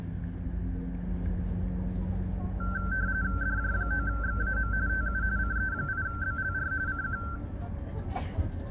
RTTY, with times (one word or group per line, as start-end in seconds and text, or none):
3.4-4.7 DJ9XAM
4.9-5.2 TU
5.4-6.7 CE8BLR
6.9-7.2 CQ